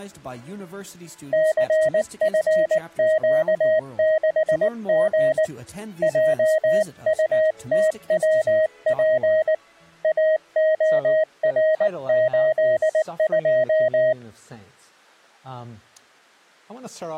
Morse code, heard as a keyed tone, hand-sent with a paddle, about 19 wpm, 630 Hz. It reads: CFQ6G JUTWP AOR82